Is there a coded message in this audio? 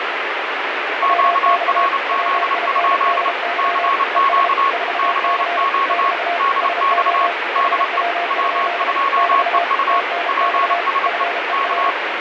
Yes: Morse code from 1.0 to 12.0 s, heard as two keyed tones, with heavy radio static. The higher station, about 29 wpm, 1100 Hz: QRZ? CQ CQ DX DE W2EU PSE K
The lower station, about 33 wpm, 690 Hz: WX WINDY ES 4C <BT> SO HW? <BT> TNX FER